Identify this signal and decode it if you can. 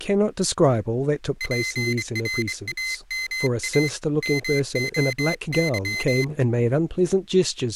Morse code (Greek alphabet), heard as a high beeper, hand-sent with a straight key, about 24 wpm, 2050 Hz, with speech in English. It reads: ΠΡΑΜΑ ΜΟΥ